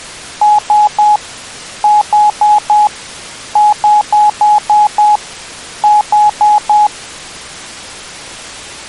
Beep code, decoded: 3-4-6-4

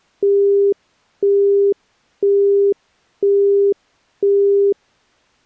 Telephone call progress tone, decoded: busy tone

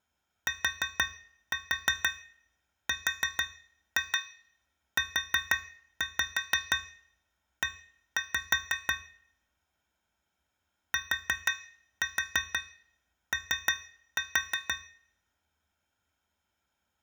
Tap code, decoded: TRUE TO

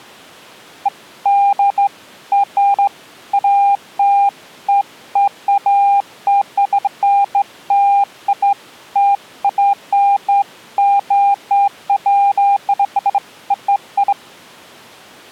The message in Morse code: none

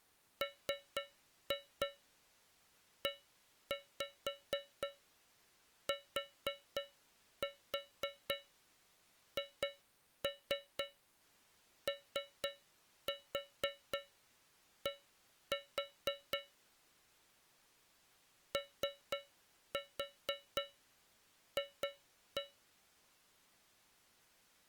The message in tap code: METHOD OF

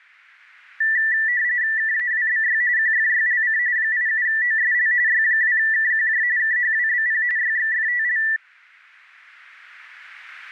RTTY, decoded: KAWBY QFYLC 87OSL Y2KQJ KHWBP YXFTL

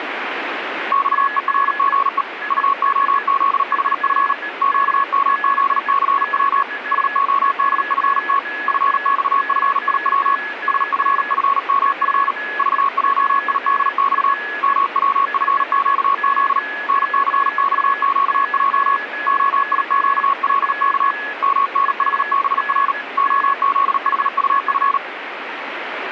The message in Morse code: XERGE UOZHF QMZCW SODFT FXFIW SFFMF VJIDX MWFQZ NCXQJ OIQLK MNHBR OZHUF

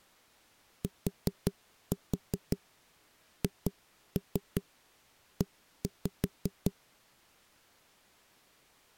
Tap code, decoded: THE

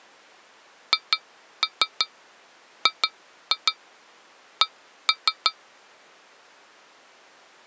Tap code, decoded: HGC

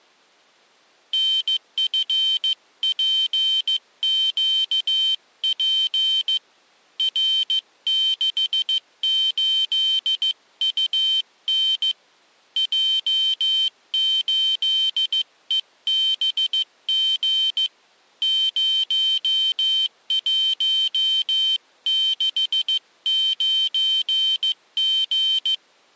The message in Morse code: NFPQP R68UN J8EBG 0169G

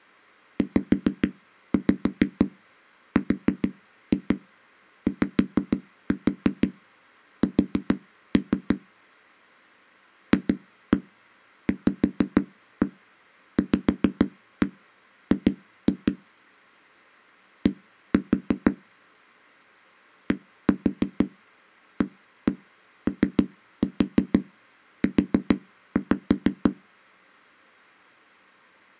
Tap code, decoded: ZRYS FVVG D DAOU

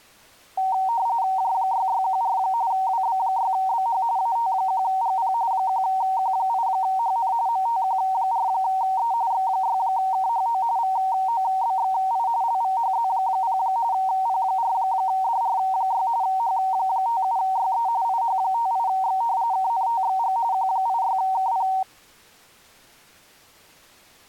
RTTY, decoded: J6614 WB6BH AT1GP 1Q8HN MTQ4E X6KHO VOBXI LVHZ0 P4DR6 H57YE IH58X KNTXG Q86KP

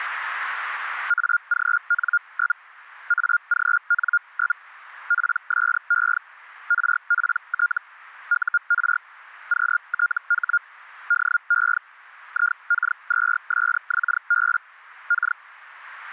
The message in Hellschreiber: AGN? AGN? PSE RPT UR QTH DE IK2SXB K

